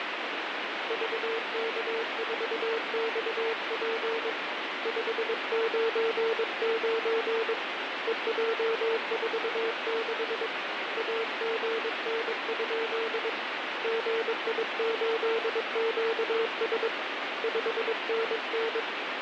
Morse code, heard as a keyed tone, hand-sent with a paddle, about 22 wpm, 450 Hz, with heavy radio static. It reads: VK4XP 599 EJ46 AGN? GI8QS 5NN